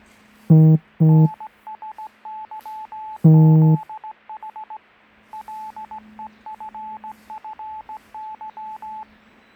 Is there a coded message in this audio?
Yes: Morse code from 1.0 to 9.1 s, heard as a keyed tone, hand-sent with a straight key, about 17 wpm, 870 Hz, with the noise of a residential street. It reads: NSYZH LEFFY